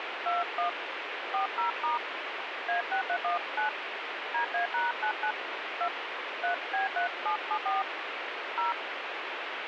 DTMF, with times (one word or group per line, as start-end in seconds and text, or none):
0.3-0.7 21
1.3-2.0 40*
2.7-3.7 A6319
4.3-5.3 DA#99
5.8-5.9 2
6.4-7.8 3B3774
8.6-8.7 0